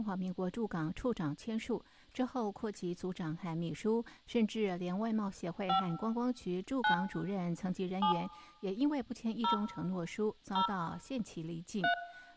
DTMF, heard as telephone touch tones, dialled by hand, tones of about 100 ms, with room echo and speech in Chinese. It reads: 5 9 7 0 0 3